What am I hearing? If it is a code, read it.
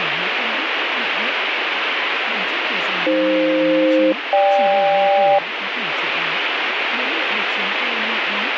Aircraft SELCAL, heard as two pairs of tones, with radio static and speech in Vietnamese. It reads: AF-GK